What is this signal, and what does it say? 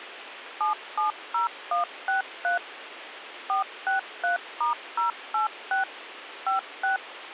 DTMF, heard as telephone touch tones, dialled by machine, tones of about 130 ms, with phone line noise. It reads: 770163 463*086 56